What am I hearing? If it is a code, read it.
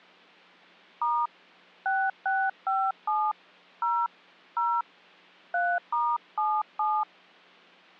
DTMF, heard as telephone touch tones, dialled by hand, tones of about 240 ms. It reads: * 6657 0 0 3*77